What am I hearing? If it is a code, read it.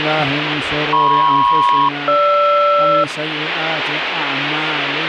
Aircraft SELCAL, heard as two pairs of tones, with radio static. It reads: MP-GR